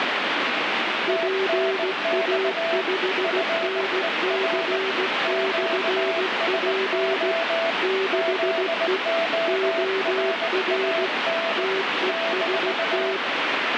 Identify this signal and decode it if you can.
Morse code, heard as two keyed tones, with heavy radio static. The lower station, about 16 wpm, 380 Hz: PA5NC/P 6E OR TEST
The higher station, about 19 wpm, 660 Hz: TNX FER QSO ZORAN -